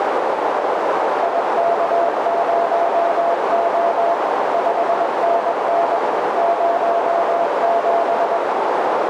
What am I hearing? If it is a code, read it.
Morse code, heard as a keyed tone, machine-sent, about 21 wpm, 680 Hz, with heavy radio static and a narrow filter. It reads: IK0O 5NN 07